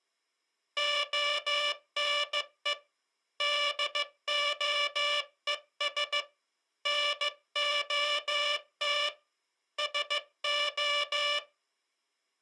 Morse code, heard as a buzzer, hand-sent with a bug key, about 15 wpm. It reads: ONE DOES NOT SO